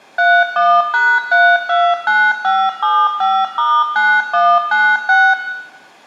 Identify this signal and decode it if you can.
DTMF, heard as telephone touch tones, dialled by machine, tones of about 250 ms, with room echo. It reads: 31#329575*9196